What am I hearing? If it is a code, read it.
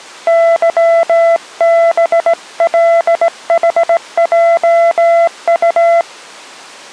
Morse code, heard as a keyed tone, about 17 wpm, 670 Hz. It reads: YBLHJU